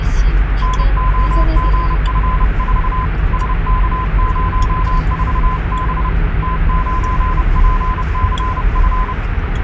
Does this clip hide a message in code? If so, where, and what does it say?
Yes: Morse code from 0.6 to 9.2 s, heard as a keyed tone, hand-sent with a paddle, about 30 wpm, 1020 Hz, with radio static and the noise inside a car. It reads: NOGF4 SK04B T9PCF